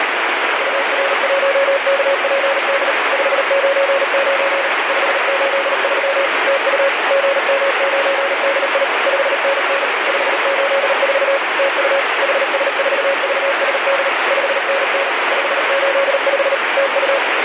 Morse code, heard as a keyed tone, machine-sent, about 38 wpm, 550 Hz, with heavy radio static. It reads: UR1KPD 599 583 TU GM9DI 5NN 584 TU HS4VSD 5NN 585 TU